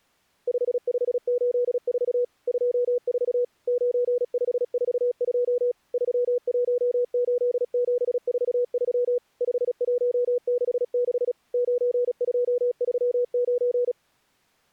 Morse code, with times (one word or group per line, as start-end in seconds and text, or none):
0.5-2.2 5584
2.5-3.4 24
3.7-5.7 9542
5.9-9.2 318743
9.4-11.3 5166
11.5-13.9 9239